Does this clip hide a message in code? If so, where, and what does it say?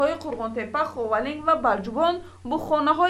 No.